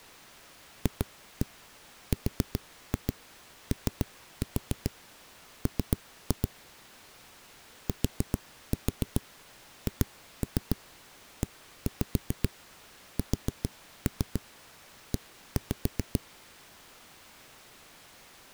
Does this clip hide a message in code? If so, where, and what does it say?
Yes: tap code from 0.9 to 16.2 s, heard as knocks on a wall, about 7 knocks a second. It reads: FROM THESE